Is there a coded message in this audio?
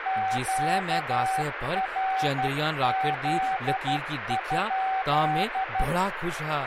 Yes: Morse code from 0.0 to 5.9 s, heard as a keyed tone, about 12 wpm, 760 Hz, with radio static and speech in Dogri. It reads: QRZ?